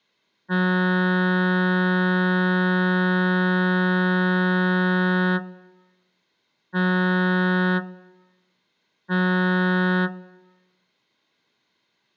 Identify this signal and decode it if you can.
Ship horn signal, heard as a ship's horn, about 180 Hz, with room echo. 1 long, 2 short. At sea: a vessel in fog that is sailing, fishing, towing or hampered.